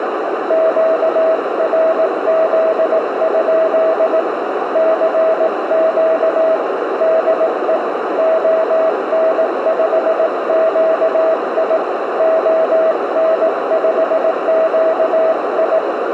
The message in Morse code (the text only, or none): QRZ? CQ DE ON5QI ON5QI